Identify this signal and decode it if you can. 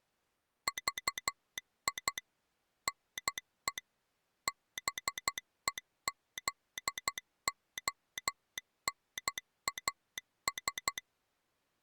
Morse code, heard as a telegraph sounder, machine-sent, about 12 wpm. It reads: VI NE BEZONAS